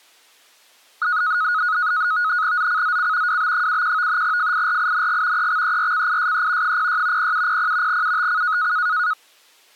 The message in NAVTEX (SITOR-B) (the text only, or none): ZCZC WB71 FIRING EXERCISE 06 0700 UTC